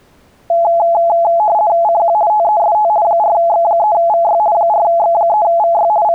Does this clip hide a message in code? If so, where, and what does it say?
Yes: RTTY (50 baud, 170 Hz shift) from 0.5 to 6.1 s, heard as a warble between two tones, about 760 Hz centre. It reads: CQ TEST 4X3VY 4X3VY …